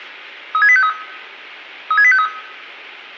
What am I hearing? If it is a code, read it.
Five-tone selective call (ZVEI), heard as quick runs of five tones, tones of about 70 ms, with room echo. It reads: 36853 36853